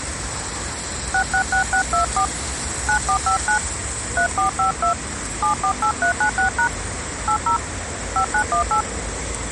DTMF, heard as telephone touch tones, dialled by hand, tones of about 100 ms, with street noise. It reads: 666624 9459 3452 748396# 80 5918